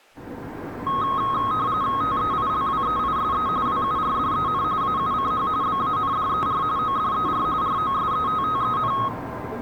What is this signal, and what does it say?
RTTY (45.45 baud, 170 Hz shift), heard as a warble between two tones, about 1180 Hz centre, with the noise inside a lift. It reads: TEILWEISE WURDEN AUCH BANDER ODER ROSETTEN